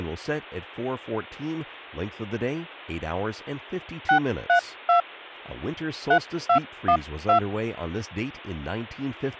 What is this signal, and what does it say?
DTMF, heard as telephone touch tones, dialled by hand, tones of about 100 ms, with hum and speech in English. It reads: 632 3212